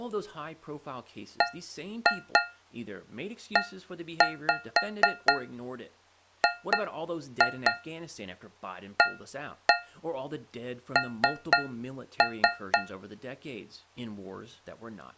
Tap code, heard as taps on a metal pipe, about 4 knocks a second, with speech in English. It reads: BEGAN